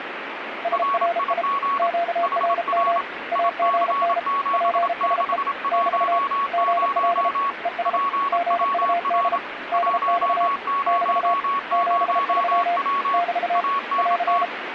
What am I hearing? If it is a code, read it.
Morse code, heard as two keyed tones, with radio static. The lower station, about 33 wpm, 690 Hz: SRI QRM AGN PSE <BT> GL ES GUD DX <BT> 73 <BT> <AR>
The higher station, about 27 wpm, 1110 Hz: RIG HR IC7610 PWR 100W ANT